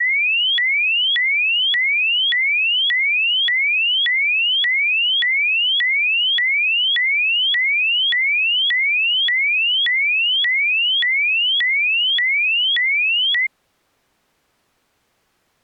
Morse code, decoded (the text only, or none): none